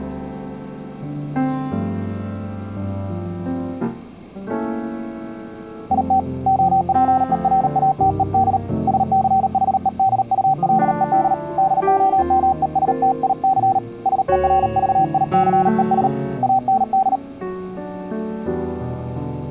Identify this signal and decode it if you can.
Morse code, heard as a keyed tone, hand-sent with a paddle, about 38 wpm, 770 Hz. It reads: IT OPERATED SCHEDULED DOMESTIC SERVICES AND